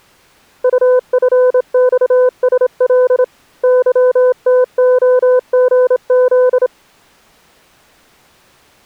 Morse code, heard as a keyed tone, hand-sent with a straight key, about 27 wpm, 500 Hz. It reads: UFXSL YTOGZ